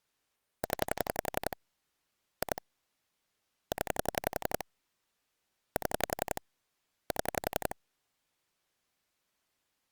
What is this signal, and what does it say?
Pulse dialling, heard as clicks on a phone line, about 11 pulses a second. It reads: 0 2 0 7 7